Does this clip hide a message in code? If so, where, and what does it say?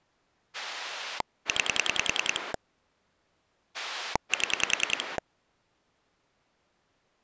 Yes: pulse dialling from 0.5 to 5.2 s, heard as a rotary dial, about 10 pulses a second. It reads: 9 7